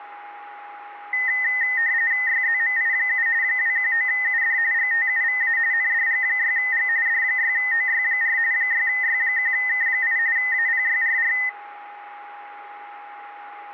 RTTY (45.45 baud, 170 Hz shift), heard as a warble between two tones, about 1950 Hz centre, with a steady whistle near 820 Hz. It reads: YZMI7 219UD GTUVA NDG6G D6OY4 6Y1K8 APYRR